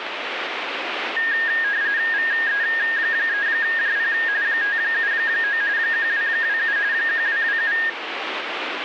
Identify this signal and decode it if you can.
RTTY (45.45 baud, 170 Hz shift), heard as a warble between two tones, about 1750 Hz centre, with radio static. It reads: VE3JP 579 1227 1227